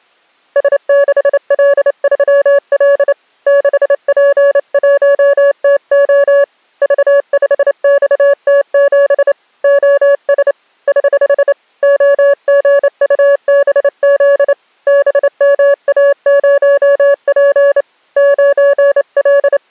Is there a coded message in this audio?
Yes: Morse code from 0.5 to 19.7 s, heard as a keyed tone, hand-sent with a straight key, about 28 wpm, 560 Hz. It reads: S6L3L 6P1TO V5XT7 OS <HH> OGUBZ BMA0P …